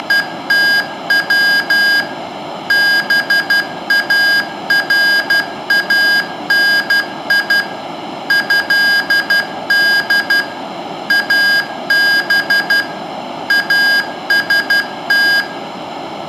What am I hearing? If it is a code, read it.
Morse code (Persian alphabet), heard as electronic beeps, machine-sent, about 12 wpm, 1600 Hz, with room echo. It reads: … بارانی ضد اب است